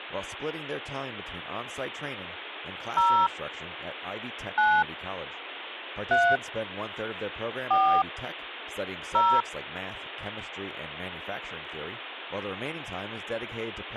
DTMF, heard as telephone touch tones, dialled by hand, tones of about 260 ms. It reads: 0 9 3 4 0